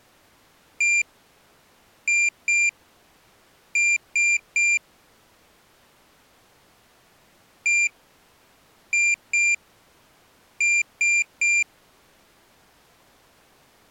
Beep code, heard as a piezo beeper, played twice, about 2400 Hz. 1-2-3. In Phoenix BIOS tables: DMA page register failure.